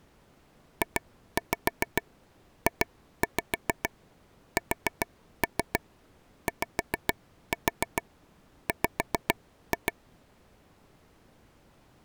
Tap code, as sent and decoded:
2-5 2-5 4-3 5-4 5-2
JJSYW

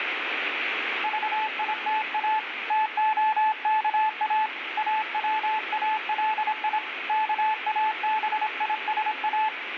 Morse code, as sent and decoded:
...- .. - .- / - --- -.- .- / .- .-- .- .-.. .. / -.- .- -... .. ... .-
VITA TOKA AWALI KABISA

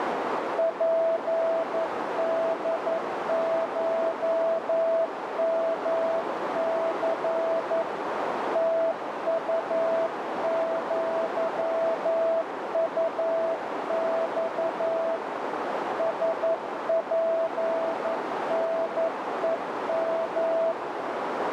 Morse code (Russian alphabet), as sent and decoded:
.--. -.. ---- -- -.-. / - ..- --.-- ..- -..- / ... .--. -. . --
ПДШМЦ ТУЪУЬ СПНЕМ

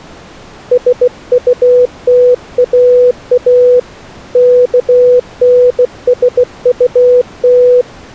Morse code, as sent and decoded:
... ..- - .- .- / -.- -. ... ..- -
SUTAA KNSUT

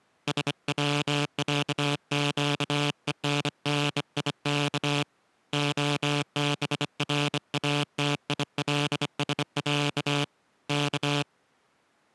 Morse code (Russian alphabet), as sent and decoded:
... .-- .-.- --.- . -. -. .. -.- / --- -... .-. .- - .. .-.. ... .-.- / -.-
СВЯЩЕННИК ОБРАТИЛСЯ К

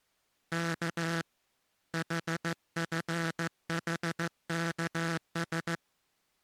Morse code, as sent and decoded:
-.- / .... ..-. .... -.- ...
K HFHKS

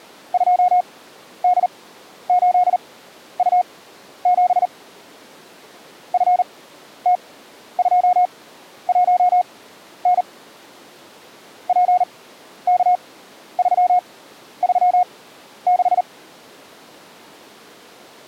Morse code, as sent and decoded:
..--- -.. ---.. ..- --... / ..-. - ..--- .---- -. / .--. -.- ...-- ...-- -....
2D8U7 FT21N PK336

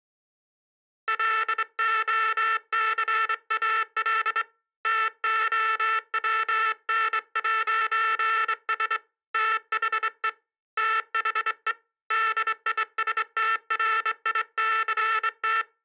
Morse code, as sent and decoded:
.-.. --- -.-. .- .-.. / - --- .-- -. .----. ... / - .... . / - .... . / -.. .. ... - .-. .. -.-. -
LOCAL TOWN'S THE THE DISTRICT

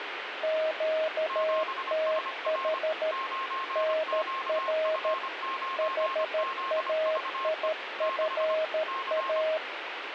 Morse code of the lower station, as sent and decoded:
--.- - .... / -. .-. / .... .- .. ..-. .-
QTH NR HAIFA

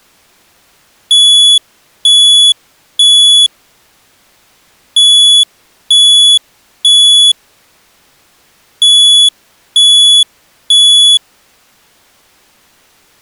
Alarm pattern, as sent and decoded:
3 beeps and a pause
temporal three

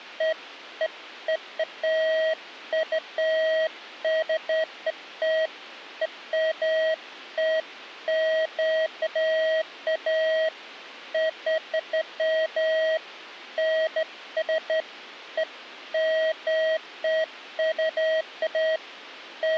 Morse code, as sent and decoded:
none

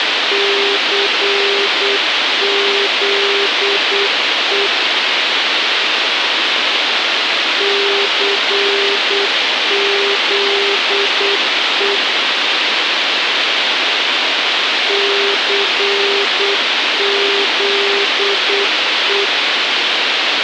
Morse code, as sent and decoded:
-.-. --.. . / -.-. --.. . / -.-. --.. .
CZE CZE CZE

